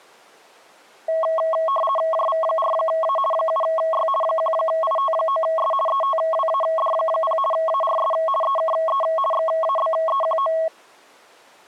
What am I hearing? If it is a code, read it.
RTTY (50 baud, 450 Hz shift), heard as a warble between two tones, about 870 Hz centre. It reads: JV4A 7Y 1IT9S ETWAD0 ARS EKE XABEQO